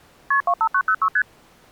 Multi-frequency trunk signalling (R1, as on North American trunks), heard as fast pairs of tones, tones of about 70 ms. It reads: KP 25906 ST